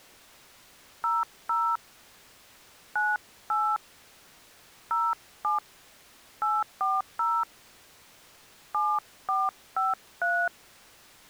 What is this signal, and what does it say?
DTMF, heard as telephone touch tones, dialled by hand, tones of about 200 ms. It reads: 00 98 07 840 7453